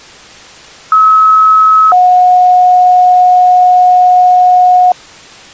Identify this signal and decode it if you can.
Two-tone page, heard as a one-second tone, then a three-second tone, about 1290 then 730 Hz.